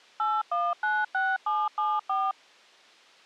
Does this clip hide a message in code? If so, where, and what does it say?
Yes: DTMF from 0.2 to 2.3 s, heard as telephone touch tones, dialled by machine, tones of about 220 ms. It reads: 8196774